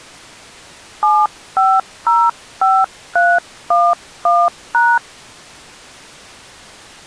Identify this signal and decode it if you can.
DTMF, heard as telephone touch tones, dialled by hand, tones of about 230 ms. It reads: 7505311#